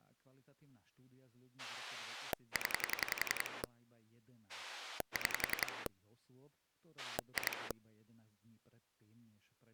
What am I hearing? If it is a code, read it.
Pulse dialling, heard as a rotary dial, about 11 pulses a second, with speech in Slovak. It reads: 0 6 2